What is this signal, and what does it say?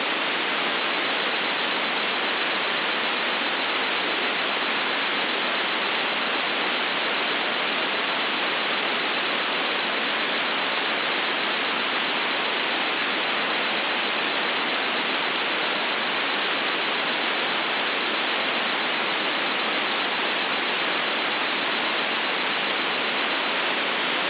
Evenly repeated beeps, with phone line noise. There is no code.